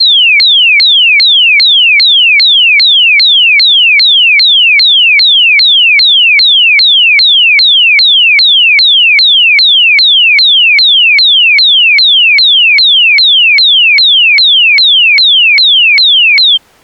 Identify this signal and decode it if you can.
A tone that sweeps in pitch again and again. There is no code.